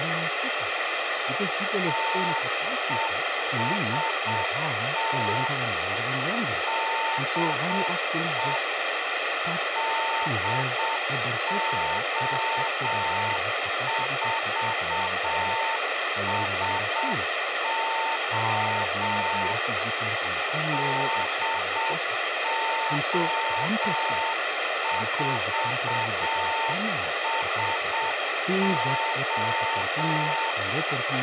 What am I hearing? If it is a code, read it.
Morse code, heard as a keyed tone, machine-sent, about 7 wpm, 900 Hz, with radio hiss, a squelch burst at the end and speech in English. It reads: TEST DE DO4SO DO4SO